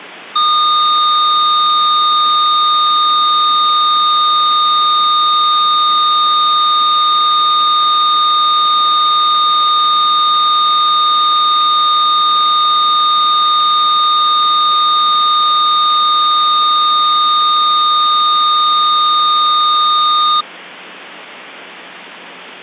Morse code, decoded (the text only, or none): none